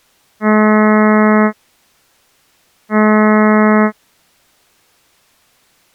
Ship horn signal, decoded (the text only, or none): 2 short